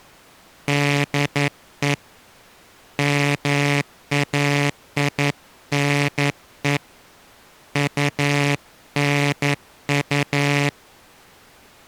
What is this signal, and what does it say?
Morse code, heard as a buzzer, hand-sent with a paddle, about 11 wpm. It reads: DE MAINE UNU